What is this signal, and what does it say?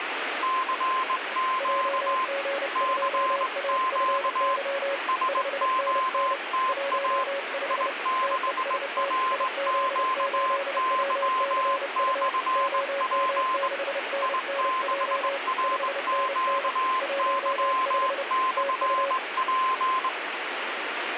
Morse code, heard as two keyed tones, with radio static. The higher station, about 20 wpm, 1040 Hz: CQ CQ SOTA I6RQY/P I6RQY/P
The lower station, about 30 wpm, 560 Hz: JG2AFY 5NN 15 TEST IZ8WCU OM6NNJ 5NN 15 TU